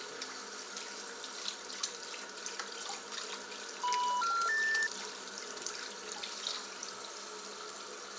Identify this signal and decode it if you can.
Telephone call progress tone (North American plan), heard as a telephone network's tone, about 980, 1370, 1800 Hz, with the noise of a restroom. Special information tone.